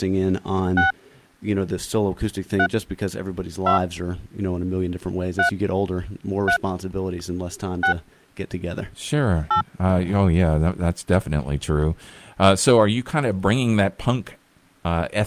DTMF, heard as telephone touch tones, dialled by hand, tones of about 100 ms, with speech in English. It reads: 6 3 2 3 3 6 8